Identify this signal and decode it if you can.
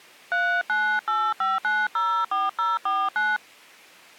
DTMF, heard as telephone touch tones, dialled by hand, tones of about 230 ms. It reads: 3985904049